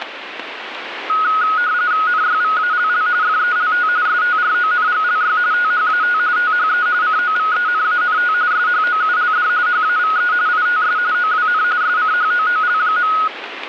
RTTY (45.45 baud, 170 Hz shift), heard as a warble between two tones, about 1360 Hz centre, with radio static. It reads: NYVALL FELT STRONGLY THAT THE COVENANT SHOULD HAVE ITS OWN SCHOOL.